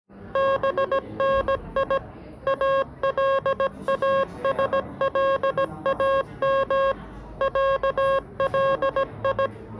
Morse code (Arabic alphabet), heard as electronic beeps, machine-sent, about 17 wpm, 540 Hz, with the noise of a cafe. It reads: بني الاسلام علي